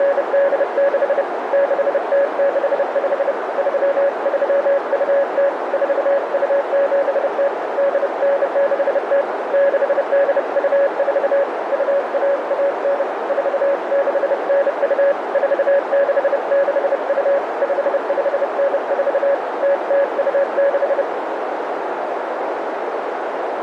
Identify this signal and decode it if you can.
Morse code (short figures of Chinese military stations), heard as a keyed tone, hand-sent with a bug key, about 30 wpm, 560 Hz, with heavy radio static and a narrow filter. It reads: … 6065 3320 4270 8960 6824 2119 4692 4662 5594 0026